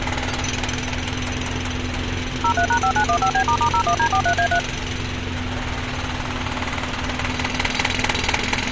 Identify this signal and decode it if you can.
DTMF, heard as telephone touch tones, dialled by machine, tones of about 80 ms, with phone line noise and street noise. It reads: 03#5915B**01D43A3